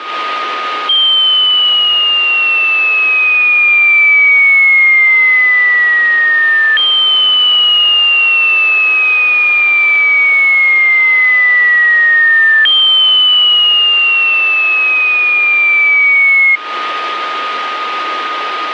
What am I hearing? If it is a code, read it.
A tone that sweeps in pitch again and again, with radio static and a steady whistle near 1240 Hz. There is no code.